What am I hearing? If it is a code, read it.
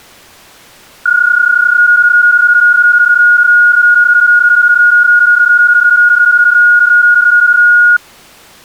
PSK31 (31.25 baud), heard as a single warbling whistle, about 1440 Hz.